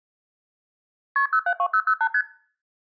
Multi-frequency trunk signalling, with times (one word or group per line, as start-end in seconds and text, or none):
1.2-1.3 KP
1.3-2.1 072008
2.1-2.2 ST